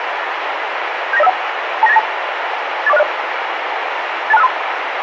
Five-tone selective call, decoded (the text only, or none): 79051 29892 84060 82653